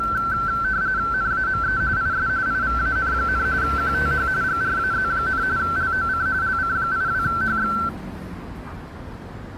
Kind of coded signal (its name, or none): RTTY